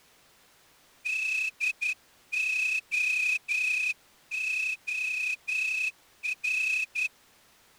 Morse code, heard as a whistle, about 11 wpm. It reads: DOOR